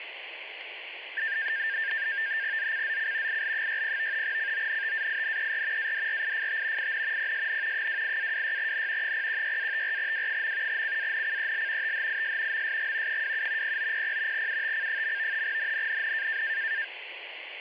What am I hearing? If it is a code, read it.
NAVTEX (SITOR-B), 100 baud, 170 Hz shift, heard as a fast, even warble, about 1700 Hz centre, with radio static. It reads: ZCZC IL60 CONTAINER ADRIFT IN PSN 28-26N 016-54W. CANCEL THIS MSG 27 0900 UTC. NNNN